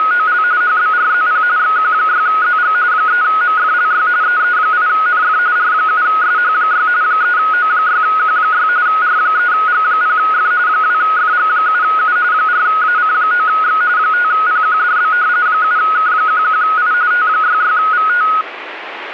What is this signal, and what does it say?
RTTY (45.45 baud, 170 Hz shift), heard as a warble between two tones, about 1360 Hz centre, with radio static. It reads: … HBRZP XQ6ZG 3MFLY EE8NF R7SH6 3O6Q6 R3G0F 2FG7U 4AC9X 5PQDB 7K11I T66VT